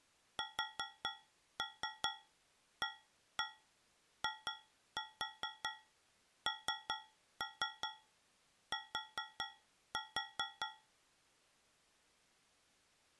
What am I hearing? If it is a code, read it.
Tap code, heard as taps on a metal pipe, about 4 knocks a second. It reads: SAINT